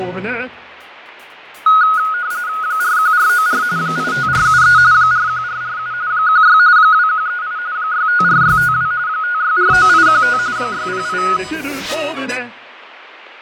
RTTY (45.45 baud, 170 Hz shift), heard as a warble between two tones, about 1360 Hz centre, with radio static and fading. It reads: 41494 85473 41447 16 2138 654652 5649815 608